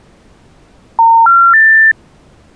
Telephone call progress tone (North American plan), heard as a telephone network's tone, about 910, 1370, 1800 Hz. Special information tone.